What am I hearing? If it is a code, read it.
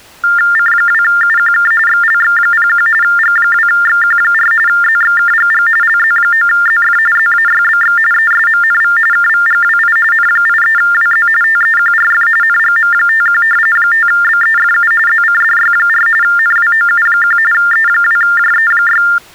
TTY/TDD text telephone tones (45.45 baud Baudot), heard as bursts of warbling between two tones, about 400 Hz shift, 1600 Hz centre. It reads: C2UQK XLX01 G2XQ4 ZXKGG LZ9ZF ZAYBX ESMNV KVGWI N83WZ TEQRF NGM51 5BEFU ZCDY4 NWOU1 E2JE6